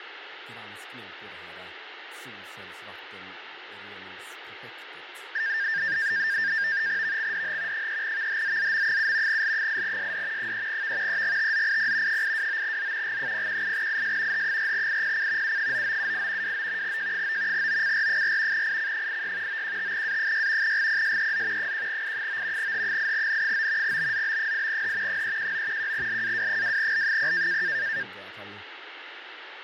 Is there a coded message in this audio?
Yes: NAVTEX (SITOR-B), 100 baud, 170 Hz shift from 5.3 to 28.0 s, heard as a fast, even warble, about 1700 Hz centre, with radio static, fading and speech in Swedish. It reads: VXDH 3VHZZM7 L8SD 3V EGTZIP 829Z G018IS H4IPC U9978 29 J9 OCR4 IC86 915A6 GPSEZ 1I9 H8N9 BZB8H 319 1LAW2L0